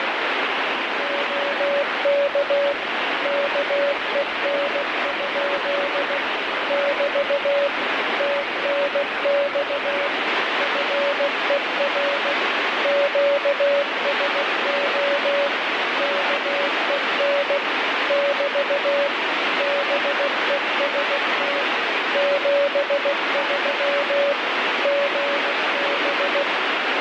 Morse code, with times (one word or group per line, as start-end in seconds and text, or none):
1.0-2.7 OK
3.3-6.2 KEN?
6.7-7.7 <BT>
8.2-10.1 TNX
10.6-12.3 FER
12.9-15.5 QSO
16.0-17.6 KEN
18.1-19.1 <BT>
19.6-21.6 BEST
22.2-24.3 73
24.9-26.4 GB